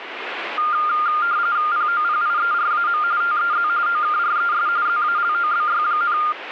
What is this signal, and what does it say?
RTTY (45.45 baud, 170 Hz shift), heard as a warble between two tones, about 1310 Hz centre, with radio static. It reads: POPIERAM TEZ OKRES ZALOBY,